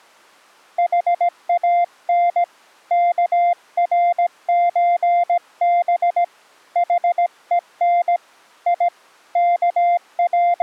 Morse code (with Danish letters), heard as a keyed tone, hand-sent with a paddle, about 17 wpm, 700 Hz. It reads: HAN KRØB HEN I …